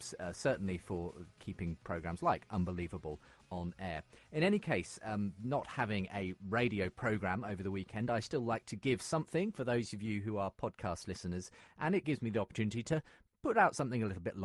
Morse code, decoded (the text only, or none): none